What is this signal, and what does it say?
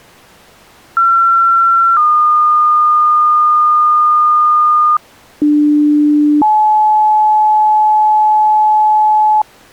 Two-tone page, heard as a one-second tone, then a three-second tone, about 1360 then 1220 Hz, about 300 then 860 Hz.